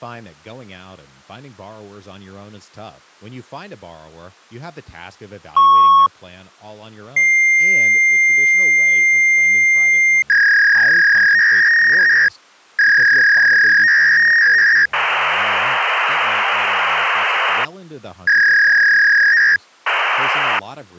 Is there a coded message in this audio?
Yes: fax machine handshake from 5.6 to 20.6 s, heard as a beep, a long tone, a warble and hiss, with speech in English.